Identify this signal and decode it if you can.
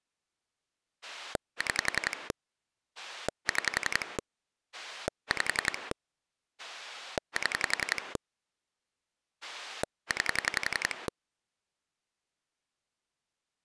Pulse dialling, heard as a rotary dial, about 11 pulses a second. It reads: 6 6 5 7 9